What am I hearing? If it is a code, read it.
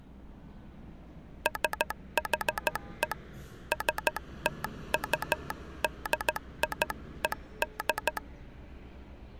Morse code (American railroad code), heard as a telegraph sounder, hand-sent with a straight key, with street noise. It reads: SHE STUDIED